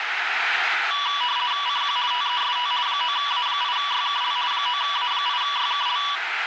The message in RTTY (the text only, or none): CQ TEST 9A8YKL 9A8YKL